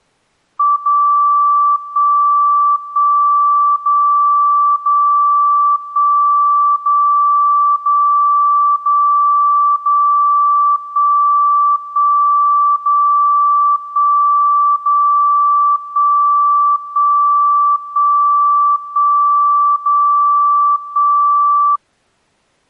Radio time signal (DCF77), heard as a tone whose level steps once a second, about 1160 Hz. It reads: 0 1 1 0 0 1 0 0 0 0 1 1 0 1 0 1 1 1 1 0 1